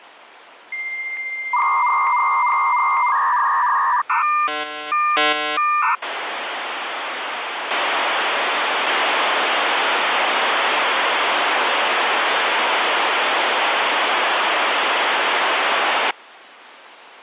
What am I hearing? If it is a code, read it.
Dial-up modem handshake (V.34 or later), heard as a whistle, warbles, then hiss, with phone line noise.